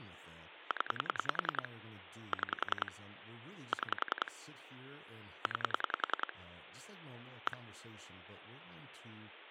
Pulse dialling, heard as clicks on a phone line, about 10 pulses a second, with speech in English. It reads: 0 6 6 9 1